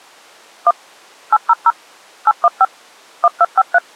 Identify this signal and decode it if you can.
DTMF, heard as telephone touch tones, dialled by machine, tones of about 40 ms. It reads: 1 800 815 1253